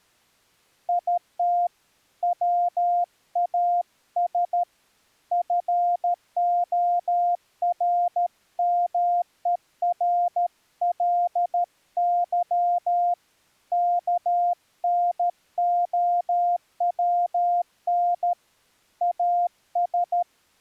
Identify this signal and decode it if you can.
Morse code, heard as a keyed tone, hand-sent with a paddle, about 13 wpm, 700 Hz. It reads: IT WAS FORMERLY KNOWN AS